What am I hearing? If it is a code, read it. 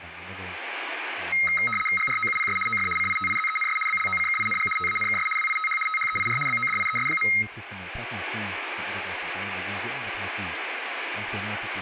RTTY (75 baud, 850 Hz shift), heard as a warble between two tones, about 1700 Hz centre, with room echo and speech in Vietnamese. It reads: GROUPS OF CITIZENS BLOCKING TANKS WITH THEIR BODIES.